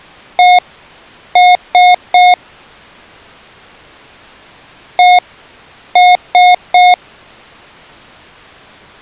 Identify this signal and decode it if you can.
Beep code, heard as beeps from a small speaker, played twice, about 720 Hz. 1-3.